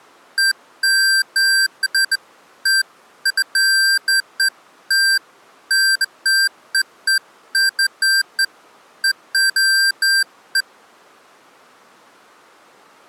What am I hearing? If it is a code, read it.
Beeps of irregular length. There is no code.